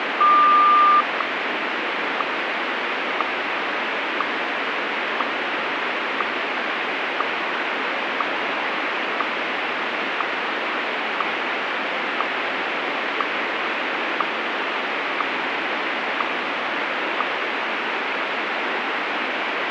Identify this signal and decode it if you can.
Radio time signal (WWVH, Hawaii), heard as ticks, one a second, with radio static.